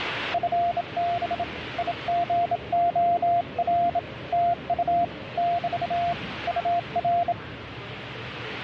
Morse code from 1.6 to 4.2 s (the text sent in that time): IGOR